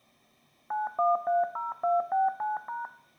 DTMF, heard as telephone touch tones, dialled by machine, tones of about 170 ms, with room echo. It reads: 9130269#